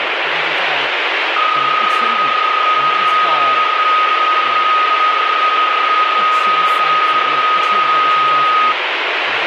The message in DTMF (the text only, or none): none